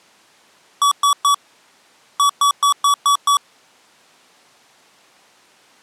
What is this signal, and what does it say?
Beep code, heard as beeps from a small speaker, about 1140 Hz. 3-6.